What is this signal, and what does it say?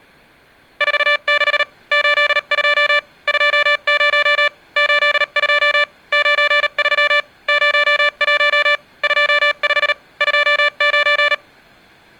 Morse code, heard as electronic beeps, machine-sent, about 38 wpm, spaced as for 34 wpm, 580 Hz. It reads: 46 82 20 82 93 01 25 29